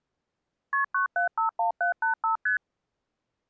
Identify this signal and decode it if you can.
Multi-frequency trunk signalling (R1, as on North American trunks), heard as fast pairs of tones, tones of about 120 ms. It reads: KP 9751785 ST